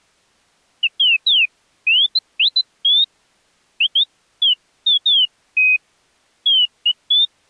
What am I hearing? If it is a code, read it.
Bird-like chirps. There is no code.